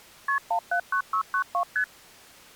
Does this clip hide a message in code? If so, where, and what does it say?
Yes: multi-frequency trunk signalling (R1, as on North American trunks) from 0.3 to 1.8 s, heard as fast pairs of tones, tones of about 90 ms. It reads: KP 179692 ST